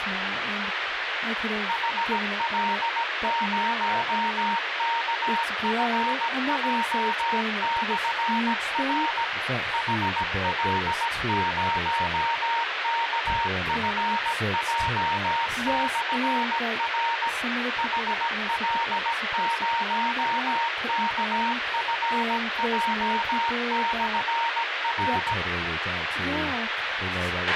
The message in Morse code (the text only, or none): HL0KFJ/R HL0KFJ/R HL0KFJ/R